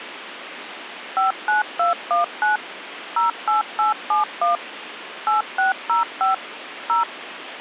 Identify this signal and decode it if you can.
DTMF, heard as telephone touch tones, dialled by machine, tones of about 140 ms, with phone line noise. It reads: 59219 08871 8605 0